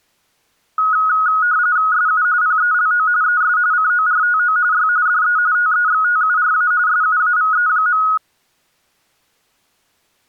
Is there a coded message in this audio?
Yes: RTTY (45.45 baud, 170 Hz shift) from 0.8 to 8.2 s, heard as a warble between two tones, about 1360 Hz centre. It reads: SU PELO ES CORTO Y DE TEXTURA SUAVE.